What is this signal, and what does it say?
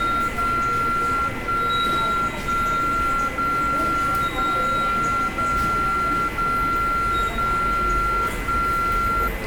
Radio time signal (DCF77), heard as a tone whose level steps once a second, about 1370 Hz, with radio static, a steady whistle near 2030 Hz and the noise of a subway station. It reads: 0 1 1 0 0 0 0 0 1